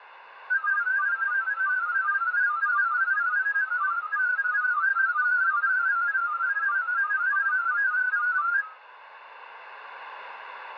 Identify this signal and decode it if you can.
Multi-tone FSK (Olivia or MFSK type), about 500 Hz wide, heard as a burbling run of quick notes, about 31.25 baud.